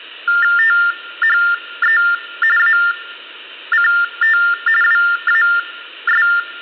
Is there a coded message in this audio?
Yes: TTY/TDD text telephone tones (45.45 baud Baudot) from 0.3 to 6.4 s, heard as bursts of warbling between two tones, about 400 Hz shift, 1600 Hz centre. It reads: THE ACT WAS